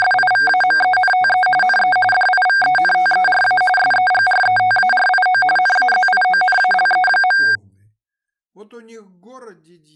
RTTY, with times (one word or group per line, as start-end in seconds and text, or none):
0.0-1.5 …
1.6-2.0 NE
2.1-3.6 DIVENTERA
3.8-5.4 SEGRETARIO
5.6-7.4 NAZIONALE.